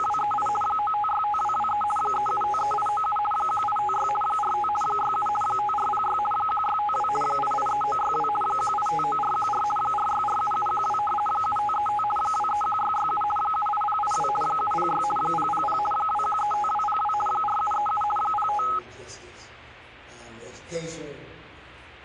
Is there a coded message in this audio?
Yes: RTTY (50 baud, 450 Hz shift) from 0.0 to 18.8 s, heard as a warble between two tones, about 1060 Hz centre, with static crashes. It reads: … 9565223 3753897 1856 45 67 5406 1652 883962 1859414 4647712 7535 231667 78082 706 000 2135202 4737 05